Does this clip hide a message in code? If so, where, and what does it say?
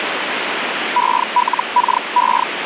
Yes: Hellschreiber (Feld-Hell, 122.5 baud) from 1.0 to 2.4 s, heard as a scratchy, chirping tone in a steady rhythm, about 980 Hz, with radio static. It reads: ELKE